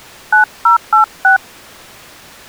DTMF, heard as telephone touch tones, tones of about 120 ms. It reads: 9086